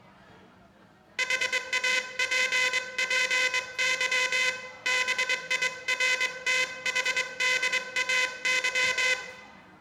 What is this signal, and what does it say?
Morse code, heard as a buzzer, hand-sent with a straight key, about 22 wpm, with room echo and the noise of a restaurant. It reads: HAPPY BIRTHDAY